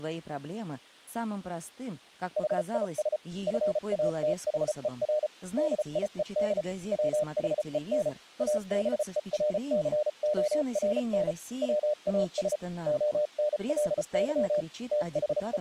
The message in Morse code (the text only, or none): HIS FATHER DIED WHEN ABERCORN WAS ONLY …